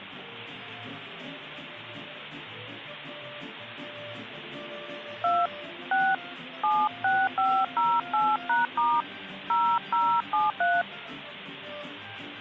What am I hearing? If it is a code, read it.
DTMF, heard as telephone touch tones, dialled by hand, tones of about 220 ms. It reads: 2 6 76508#* 0073